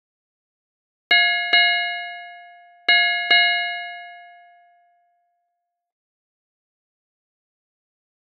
Ship's bell, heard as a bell. 4. Four half-hours of the watch have passed.